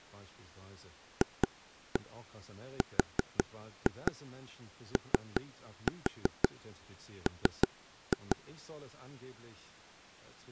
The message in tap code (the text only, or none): FROM